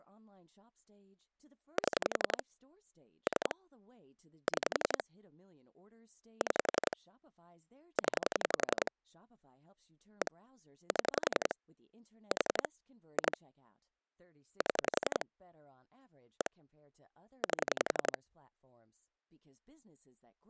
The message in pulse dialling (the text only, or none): 7 3 6 6 0 1 7 4 2 7 1 8